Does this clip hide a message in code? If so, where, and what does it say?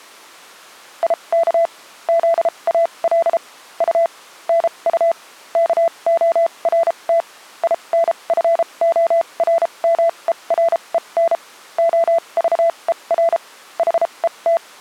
Yes: Morse code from 1.0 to 14.6 s, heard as a keyed tone, machine-sent, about 33 wpm, spaced as for 26 wpm, 670 Hz. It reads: IK ZAL U NU KORT INFORMEREN OVER HET